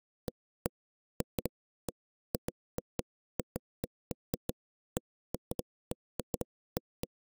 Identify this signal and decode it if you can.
Irregular knocks on wood. There is no code.